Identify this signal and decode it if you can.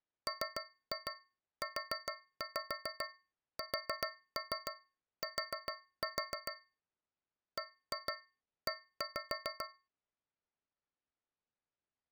Tap code, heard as taps on a metal pipe, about 7 knocks a second. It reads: MUST BE